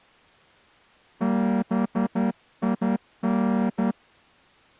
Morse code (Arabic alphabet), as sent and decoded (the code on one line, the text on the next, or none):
-... .. -.
بين